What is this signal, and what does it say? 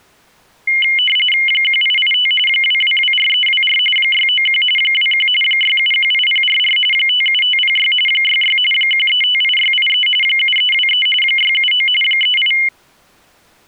RTTY (45.45 baud, 850 Hz shift), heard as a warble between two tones, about 2550 Hz centre. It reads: 1885 2224324 691 21 6718044 57506 66 1358683 7323 679 38